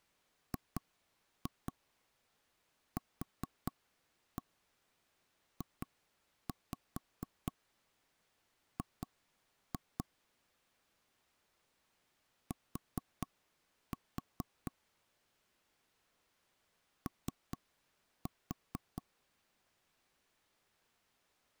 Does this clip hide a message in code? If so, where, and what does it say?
Yes: tap code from 0.5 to 19.0 s, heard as knocks on wood, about 4 knocks a second. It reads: GQJG T O